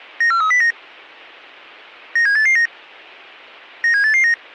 Five-tone selective call (CCIR), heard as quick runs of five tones, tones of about 100 ms. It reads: 94309 97889 97889